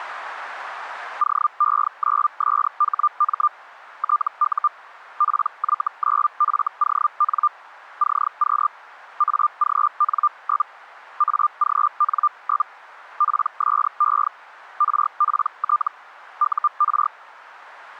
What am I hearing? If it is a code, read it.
Hellschreiber (Feld-Hell, 122.5 baud), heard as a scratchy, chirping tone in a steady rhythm, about 1200 Hz. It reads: OE9SHM TU PY9FON CQ AGN? AGN? PSE RPT UR